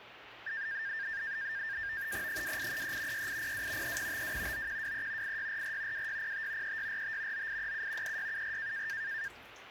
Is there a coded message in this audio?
Yes: NAVTEX (SITOR-B), 100 baud, 170 Hz shift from 0.5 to 9.3 s, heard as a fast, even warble, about 1700 Hz centre, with radio static and kitchen noise. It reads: 2833 6802 3052 9123 8644 2605 3645 9837 3674